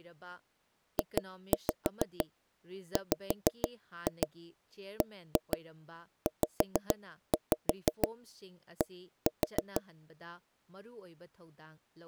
Tap code, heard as taps on a table, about 6 knocks a second, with speech in Manipuri. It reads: JWBZD